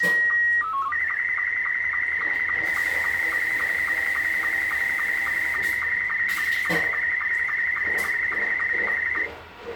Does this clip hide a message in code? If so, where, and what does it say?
Yes: SSTV (slow-scan television), Scottie S2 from 0.0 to 9.2 s, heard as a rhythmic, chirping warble, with the noise of a restroom.